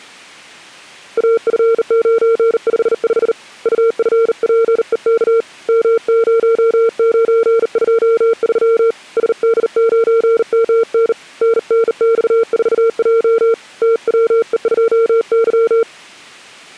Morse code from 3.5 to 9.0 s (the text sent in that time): UFPEK M0923